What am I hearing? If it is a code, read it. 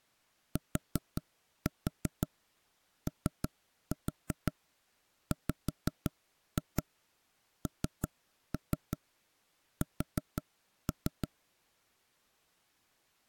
Tap code, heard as knocks on wood, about 5 knocks a second. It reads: TOWNS